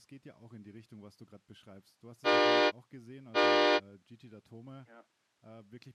Train horn signal, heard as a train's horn, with speech in German. 2 short. On North American railways: a signal is acknowledged.